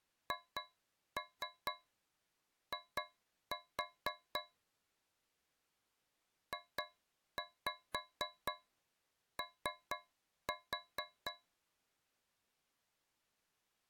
Tap code, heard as taps on a metal pipe, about 4 knocks a second. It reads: HI JO